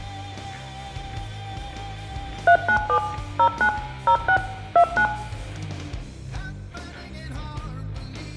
DTMF, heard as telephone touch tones, dialled by machine, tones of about 80 ms, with room echo. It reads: 397 09 06 29